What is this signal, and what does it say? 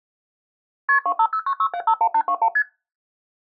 Multi-frequency trunk signalling (R1, as on North American trunks), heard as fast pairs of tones, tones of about 70 ms. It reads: KP 25096751821 ST